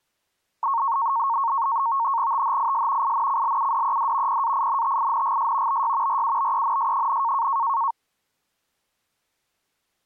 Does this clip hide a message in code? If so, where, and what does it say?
Yes: NAVTEX (SITOR-B), 100 baud, 170 Hz shift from 0.6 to 7.9 s, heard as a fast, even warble, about 1010 Hz centre. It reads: THIS INCLUDED PAINTINGS BY RUBENS,